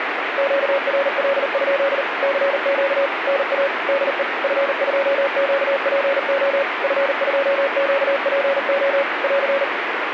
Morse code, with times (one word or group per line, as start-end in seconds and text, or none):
0.4-2.0 QRL?
2.2-3.1 CQ
3.3-3.7 NA
3.9-4.2 DE
4.4-6.6 F2QPO
6.8-9.0 F2QPO
9.2-9.6 <AR>